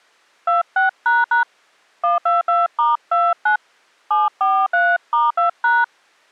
DTMF, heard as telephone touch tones, dialled by hand, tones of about 180 ms. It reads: 26## 122*29 743*2#